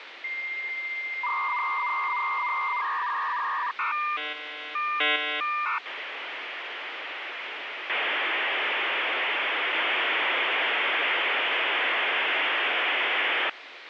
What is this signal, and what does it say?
Dial-up modem handshake (V.34 or later), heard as a whistle, warbles, then hiss, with phone line noise.